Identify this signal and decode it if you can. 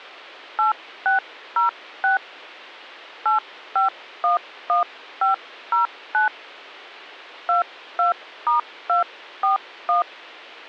DTMF, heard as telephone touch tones, dialled by hand, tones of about 130 ms. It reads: 8606 8511509 22*241